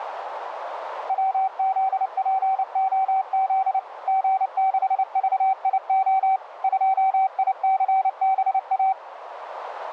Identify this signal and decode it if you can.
Morse code, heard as a keyed tone, machine-sent, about 29 wpm, 770 Hz, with radio static and a narrow filter. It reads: WZPOZ G6VIO 2ICBA